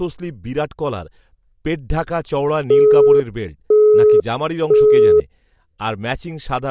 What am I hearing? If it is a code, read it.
Telephone call progress tone (single-tone plan, as in Europe, Japan and elsewhere), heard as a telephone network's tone, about 420 Hz, 0.5 s on and 0.5 s off, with speech in Bangla. Busy tone.